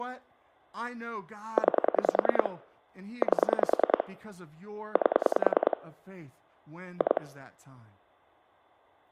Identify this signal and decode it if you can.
Pulse dialling, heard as clicks on a phone line, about 10 pulses a second, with speech in English. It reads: 9 8 8 2